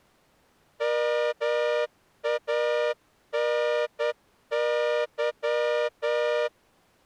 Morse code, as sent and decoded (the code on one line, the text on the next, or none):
-- .- -. -.--
MANY